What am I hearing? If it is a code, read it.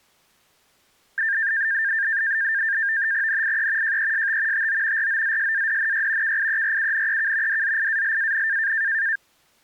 NAVTEX (SITOR-B), 100 baud, 170 Hz shift, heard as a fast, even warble, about 1700 Hz centre. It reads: NIE JEST TO ROZSADNY KIERUNEK DZIALAN